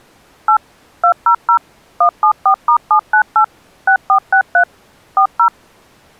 DTMF, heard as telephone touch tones, dialled by machine, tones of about 90 ms. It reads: 8 200 174*798 6463 40